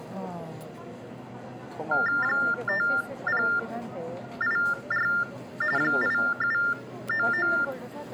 TTY/TDD text telephone tones (45.45 baud Baudot), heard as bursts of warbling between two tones, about 400 Hz shift, 1600 Hz centre, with the noise of a crowd indoors. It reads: 5084 8799